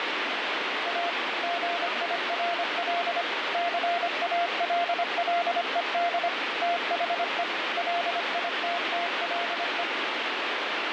Morse code, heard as a keyed tone, machine-sent, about 25 wpm, 690 Hz, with heavy radio static. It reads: A GIRL CALLED THE LITTLE